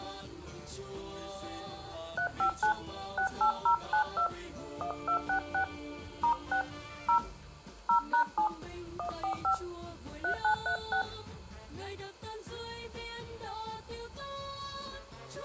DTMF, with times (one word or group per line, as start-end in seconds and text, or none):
2.2-2.7 359
3.2-4.3 68092
4.8-5.6 1266
6.2-6.6 *6
7.1-7.2 0
7.9-8.5 0#7
9.0-9.5 145
10.2-11.0 3936